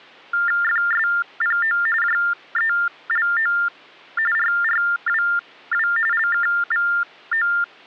TTY/TDD text telephone tones (45.45 baud Baudot), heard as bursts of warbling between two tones, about 400 Hz shift, 1600 Hz centre. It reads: FSPO JELO RRWW LKVO